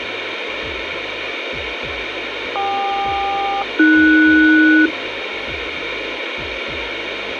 Aircraft SELCAL, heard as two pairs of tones, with radio hiss. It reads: KQ-AS